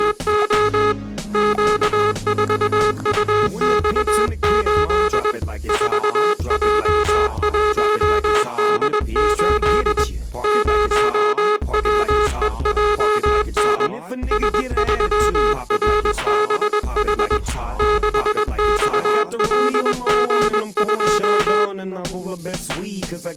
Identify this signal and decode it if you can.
Morse code, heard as a buzzer, hand-sent with a paddle, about 21 wpm. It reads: … Q4UX8 4J1D8 0WEJN S3RBH 6XLG2